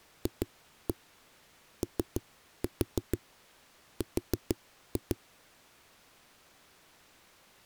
Tap code, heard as knocks on a wall, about 6 knocks a second. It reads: FOR